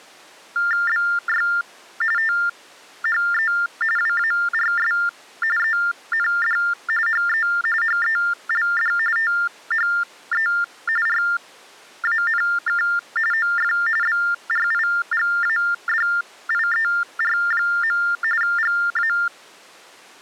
TTY/TDD text telephone tones (45.45 baud Baudot), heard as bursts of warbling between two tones, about 400 Hz shift, 1600 Hz centre. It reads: BY THE WARS END HE HELD THE RANK OF BRIGADIER. GA